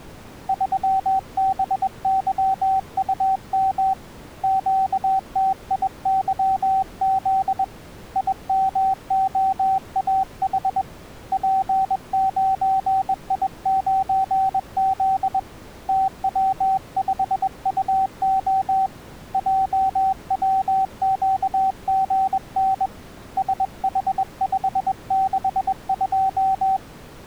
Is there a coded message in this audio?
Yes: Morse code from 0.4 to 26.8 s, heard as a keyed tone, hand-sent with a bug key, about 21 wpm, 770 Hz. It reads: 3BYUM QTIYZ IMOAH P9I9Z TW5UO JWQGN SH562